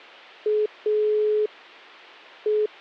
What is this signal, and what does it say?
Telephone call progress tone (pulsed, as in Italy), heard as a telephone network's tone, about 420 Hz. Dial tone.